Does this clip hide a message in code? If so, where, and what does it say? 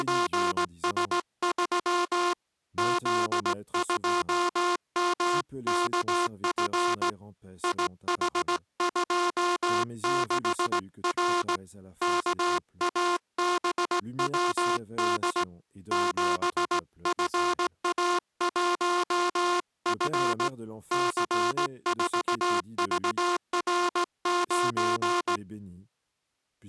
Yes: Morse code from 0.0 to 25.4 s, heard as a buzzer, hand-sent with a straight key, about 17 wpm, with speech in French. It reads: … Z2MKF IH26R KABWD 7FA1F C4VR9